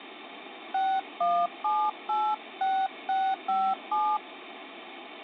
DTMF, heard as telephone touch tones, dialled by hand, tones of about 260 ms, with phone line noise. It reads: 61786657